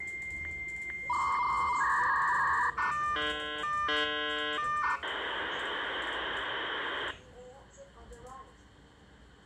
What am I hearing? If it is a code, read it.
Dial-up modem handshake (V.34 or later), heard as a whistle, warbles, then hiss, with room echo and the noise inside a subway train.